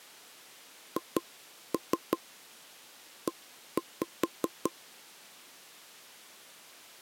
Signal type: tap code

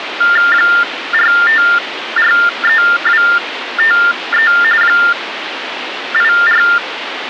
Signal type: TTY/TDD text telephone tones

